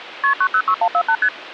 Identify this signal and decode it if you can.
Multi-frequency trunk signalling (R1, as on North American trunks), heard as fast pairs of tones, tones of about 70 ms. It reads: KP 906148 ST